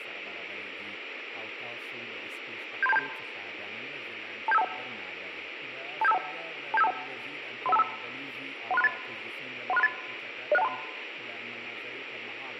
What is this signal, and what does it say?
Five-tone selective call (EIA), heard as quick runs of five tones, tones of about 30 ms. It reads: 73727 27521 27521 27521 31525 13638 13638 06123